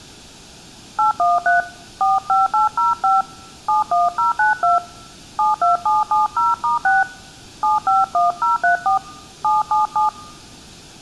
DTMF, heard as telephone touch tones, dialled by hand, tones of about 150 ms. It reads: 813 45805 71092 72770*6 751034 777